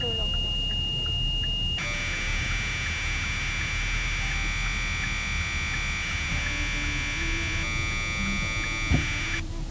Commodore tape loading (standard loader), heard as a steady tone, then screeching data, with the noise inside a car.